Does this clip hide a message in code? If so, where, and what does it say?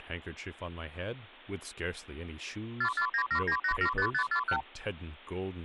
Yes: multi-frequency trunk signalling (R2, with the far end's replies) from 2.8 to 4.6 s, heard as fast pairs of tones, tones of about 80 ms, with speech in English. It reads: 44979875541